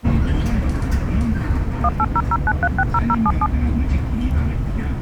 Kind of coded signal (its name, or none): DTMF